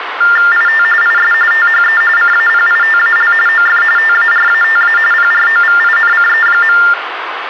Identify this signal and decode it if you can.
TTY/TDD text telephone tones (45.45 baud Baudot), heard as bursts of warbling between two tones, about 400 Hz shift, 1600 Hz centre, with phone line noise. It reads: IT IS THE CAPITAL OF TARATA PROVINCE.